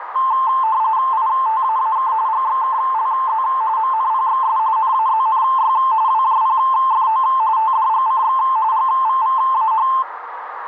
RTTY (45.45 baud, 170 Hz shift), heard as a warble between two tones, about 970 Hz centre, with radio static and a narrow filter. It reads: ITAAK GXKLZ MNPXS NAZNY WJPFO TDGCX GVVAH